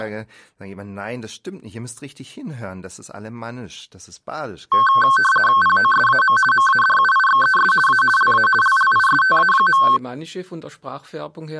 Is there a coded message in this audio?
Yes: RTTY (50 baud, 450 Hz shift) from 4.7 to 10.0 s, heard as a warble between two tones, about 1310 Hz centre. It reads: POSAM MADUIXES A LA LLISTA.